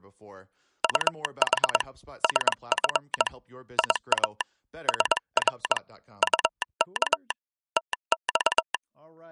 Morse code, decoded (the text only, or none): UH SF IA SR UK TX